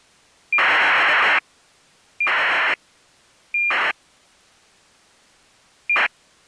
ACARS aircraft data, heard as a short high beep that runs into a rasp, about 2400 baud.